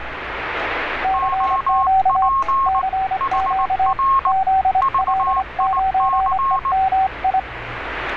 Morse code, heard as two keyed tones, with radio static and street noise. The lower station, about 25 wpm, 760 Hz: CQ CQ ZL9EMI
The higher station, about 19 wpm, 1080 Hz: OP HR VIC